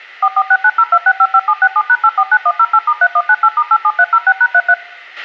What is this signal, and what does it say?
DTMF, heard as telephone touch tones, dialled by machine, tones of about 60 ms, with a squelch burst at the end. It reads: 446902655767#849108*3198*87306#33